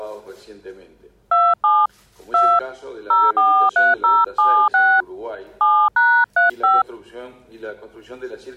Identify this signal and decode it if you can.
DTMF, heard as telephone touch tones, dialled by hand, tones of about 230 ms. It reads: 27 2 043076 7#35